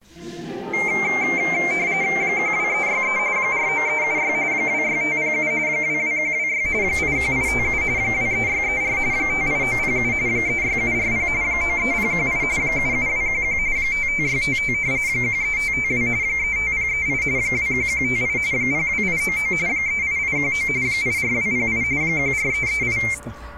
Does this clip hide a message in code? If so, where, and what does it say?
Yes: RTTY (45.45 baud, 170 Hz shift) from 0.7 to 23.1 s, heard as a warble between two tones, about 2200 Hz centre. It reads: 12363 49376 26507 22126 81857 23634 58907 36740 93018 77211 55655 13552 35038 21158 02899 38819 84208 14338